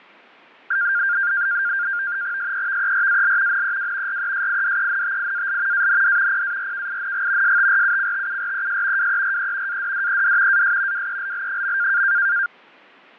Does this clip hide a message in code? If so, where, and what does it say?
Yes: NAVTEX (SITOR-B), 100 baud, 170 Hz shift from 0.7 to 12.5 s, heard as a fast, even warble, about 1500 Hz centre, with fading. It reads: SEVERAL NEW RESIDENTIAL AND PARKING STRUCTURES WERE ADDED AS WELL.